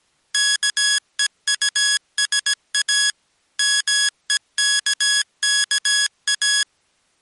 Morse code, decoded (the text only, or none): KEUSA MEKKA